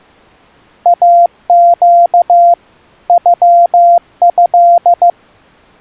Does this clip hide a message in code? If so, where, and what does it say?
Yes: Morse code (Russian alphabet) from 0.8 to 5.2 s, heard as a keyed tone, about 15 wpm, 690 Hz. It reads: АЩ ЮЭ